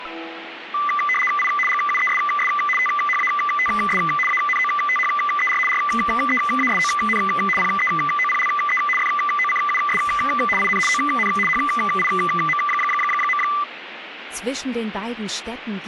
RTTY (75 baud, 850 Hz shift), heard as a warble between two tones, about 1600 Hz centre, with radio static. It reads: I GUESS THATS ANOTHER REASON PEOPLE FOCUS IN ON HIM.